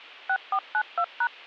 DTMF, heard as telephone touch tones, dialled by machine, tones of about 70 ms. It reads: 6492#